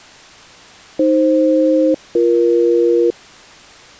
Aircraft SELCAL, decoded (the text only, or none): AF-BE